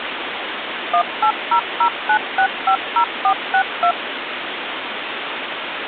DTMF, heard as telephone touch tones, dialled by machine, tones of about 80 ms, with phone line noise. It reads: 18009650462